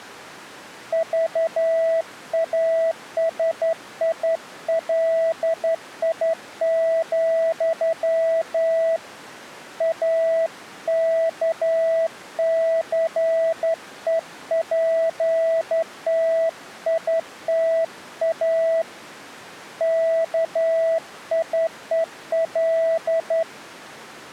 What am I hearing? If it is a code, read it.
Morse code, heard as a keyed tone, hand-sent with a straight key, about 11 wpm, 660 Hz. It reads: VASILI, AKCEPTITA KIEL